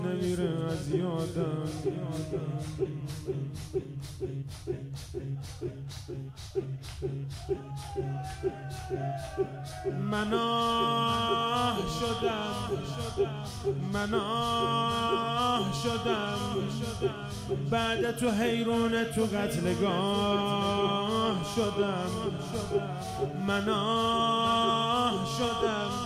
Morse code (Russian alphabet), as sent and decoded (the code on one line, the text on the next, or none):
none